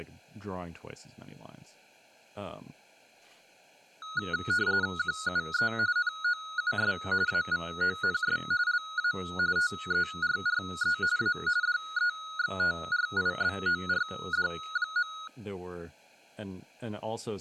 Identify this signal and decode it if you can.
RTTY (45.45 baud, 170 Hz shift), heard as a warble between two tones, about 1360 Hz centre, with speech in English. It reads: QUE NOUS AVONS LA TERRE A DEXTRIBORD.